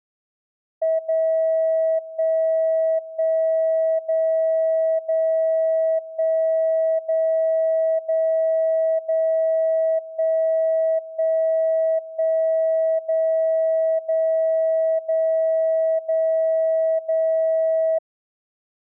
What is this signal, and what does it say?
Radio time signal (DCF77), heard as a tone whose level steps once a second, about 650 Hz. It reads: 0 1 1 0 0 1 0 0 0 1 1 1 0 0 0 0 0